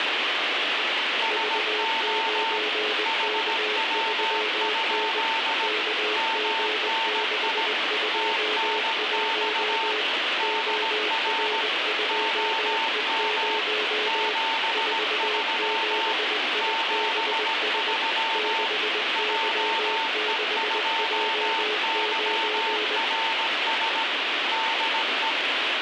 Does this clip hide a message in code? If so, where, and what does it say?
Yes: Morse code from 1.2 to 25.4 s, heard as two keyed tones, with heavy radio static. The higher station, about 17 wpm, 900 Hz: SO HW? MNI TNX DR OM 73 73 JE2YRS DE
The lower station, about 20 wpm, 430 Hz: V9K3N KG621 OR2E0 47IBS 6Y6J9